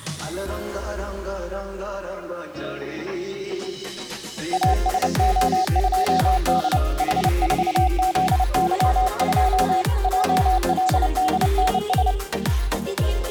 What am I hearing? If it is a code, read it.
Morse code, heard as a keyed tone, hand-sent with a paddle, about 29 wpm, 750 Hz. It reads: ASO2D H4ZY2 JLDNS